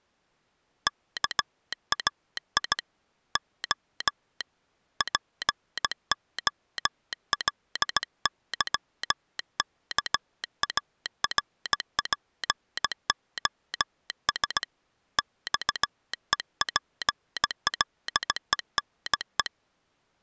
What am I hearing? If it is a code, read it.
Morse code (Greek alphabet), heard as a telegraph sounder, hand-sent with a straight key, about 17 wpm. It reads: ΚΑΙ Ο ΠΟΛΥΚΑΡΠΟΣ ΞΕΠΛΕΝΕ